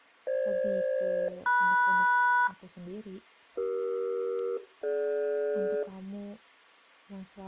Aircraft SELCAL, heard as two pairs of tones, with speech in Indonesian. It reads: FG-MS CE-DG